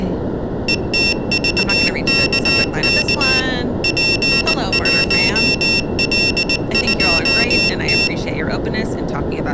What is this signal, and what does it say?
Morse code, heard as a high beeper, machine-sent, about 19 wpm, 2700 Hz, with room echo and speech in English. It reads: ETVKK P1L2T